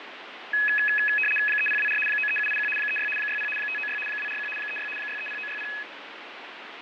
RTTY (75 baud, 850 Hz shift), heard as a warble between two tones, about 2100 Hz centre, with radio static and fading. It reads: 3024 93781 36 60 596 241 36 630960